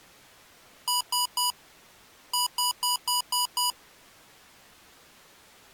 Beep code, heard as beeps from a small speaker, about 980 Hz. 3-6.